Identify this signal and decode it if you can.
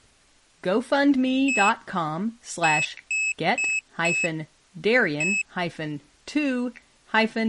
Beep code, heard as a piezo beeper, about 2600 Hz, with speech in English. 1-4-1. In Phoenix BIOS tables: address line failure in the first 64 KB of memory.